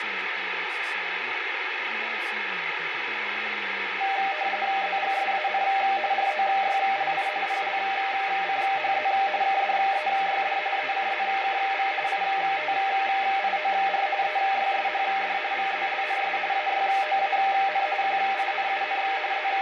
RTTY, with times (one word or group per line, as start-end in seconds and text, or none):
4.8-5.6 ZGSAN
6.1-7.3 ROYLI
7.5-9.1 PLCHZ
9.4-10.6 KDEYD
10.8-11.9 ECZKV
12.1-14.1 ITIOR
14.2-15.4 EYSHD
15.5-16.4 VZLNS
16.5-17.9 AYOAN
18.0-19.0 QINUN
19.3-19.6 …